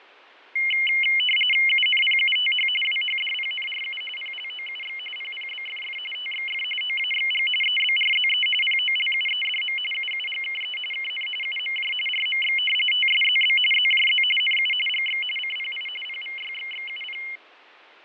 RTTY (45.45 baud, 850 Hz shift), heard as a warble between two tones, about 2550 Hz centre, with radio static and fading. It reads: UNPUTH WHDPNRU PLOUX PPBFF TXF OAXG EBRZE POLUEDM UUGKE KN UMJ RMX TSZB ZJZ NU GX CPI PVYXXUP